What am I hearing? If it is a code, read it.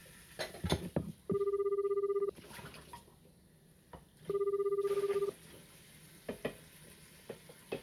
Telephone call progress tone (Japanese plan), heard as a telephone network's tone, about 380, 400, 420 Hz, 1 s on and 2 s off, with kitchen noise. Ringback tone.